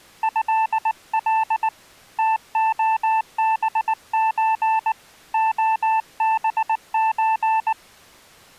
Morse code (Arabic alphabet), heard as a keyed tone, hand-sent with a paddle, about 19 wpm, 880 Hz. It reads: هل تخبز خبز